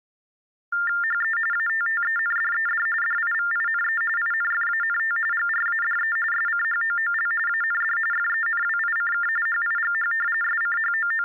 TTY/TDD text telephone tones (45.45 baud Baudot), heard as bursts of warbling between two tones, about 400 Hz shift, 1600 Hz centre. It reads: HE ATTENDED DIVINE INFANT GRADE SCHOOL AND FENWICK HIGH …